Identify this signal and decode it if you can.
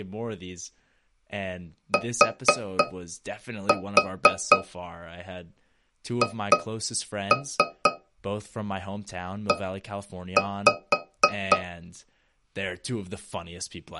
Tap code, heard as taps on a metal pipe, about 4 knocks a second, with speech in English. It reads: THE